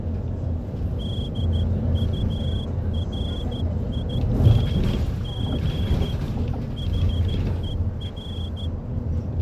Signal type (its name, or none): Morse code